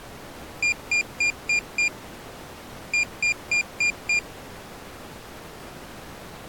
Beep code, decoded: 5-5

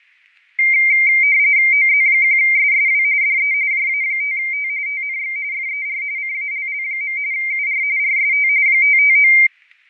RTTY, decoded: OZ1SSW DE JA5T TNX FER CALL. UR RST 559

